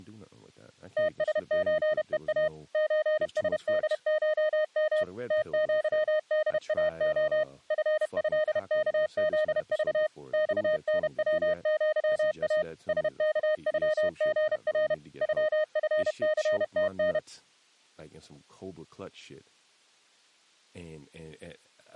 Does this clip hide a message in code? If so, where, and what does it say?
Yes: Morse code (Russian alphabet) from 0.9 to 17.2 s, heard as a keyed tone, machine-sent, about 31 wpm, 620 Hz, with speech in English. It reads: ТСЧЕА ЧСДШМ ТЪДАО ФЭКЗЖ ЬНВЪА СКЮГР ЮФЦТН